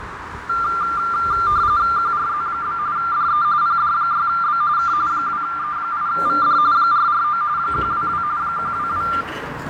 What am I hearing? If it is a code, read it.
RTTY (45.45 baud, 170 Hz shift), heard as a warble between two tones, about 1280 Hz centre, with radio static, fading, a narrow filter and the noise inside a lift. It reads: QRZ? DE PD6B K 2E8VD 449 122 122